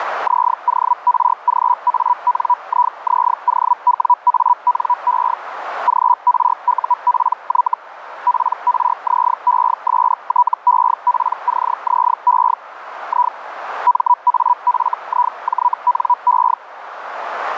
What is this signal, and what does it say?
Hellschreiber (Feld-Hell, 122.5 baud), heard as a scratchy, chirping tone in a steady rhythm, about 980 Hz, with radio static and a narrow filter. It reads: ZORGANIZOWANE GRUPY PRZESTEPCZE I MAFIJNE